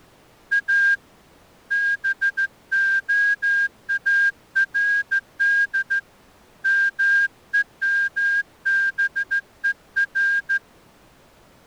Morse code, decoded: A BOARD MEMBER

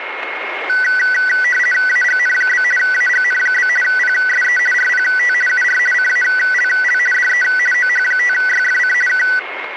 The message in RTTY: AGN? AGN? PSE RPT UR CALL DE OH5YFC K

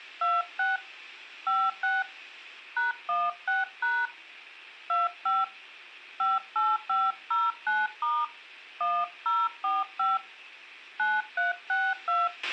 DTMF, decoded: 26 56 #16# 25 58509* 1045 9362

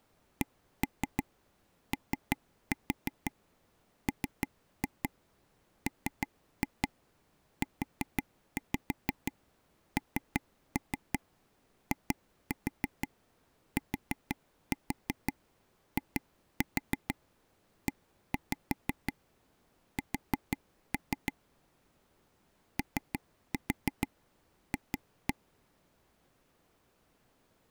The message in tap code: COMMUNITIES OF

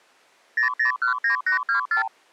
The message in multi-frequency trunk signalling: 0019824

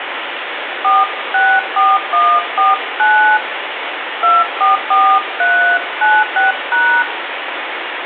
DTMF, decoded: 464149 244396#

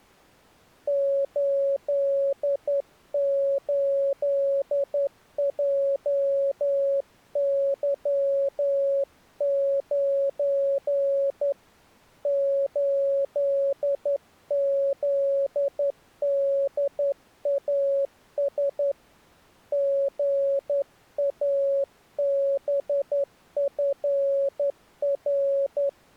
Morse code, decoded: 88JY9 8ZDAS GABFR

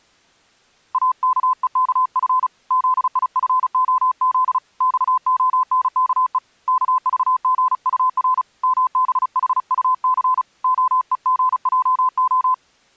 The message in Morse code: AKEKF ZIFOZ XONKE KVGUR MBHUC OEGJO

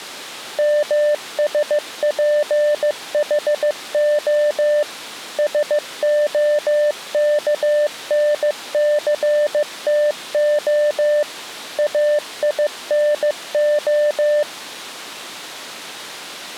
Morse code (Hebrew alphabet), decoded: משפחה שהכנסתה אינה

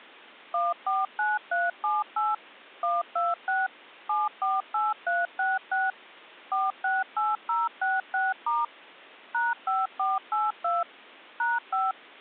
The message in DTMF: 149378 126 748366 468066* #5482 #5

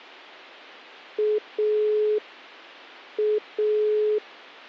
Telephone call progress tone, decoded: dial tone

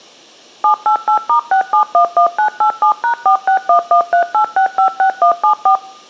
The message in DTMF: 788*6711987#461138656174

